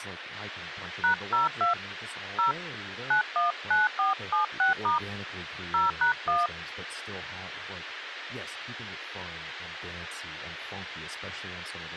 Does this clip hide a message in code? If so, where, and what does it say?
Yes: DTMF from 1.0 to 6.5 s, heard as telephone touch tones, dialled by hand, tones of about 140 ms, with radio hiss and speech in English. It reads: #02 0 919476* 0#1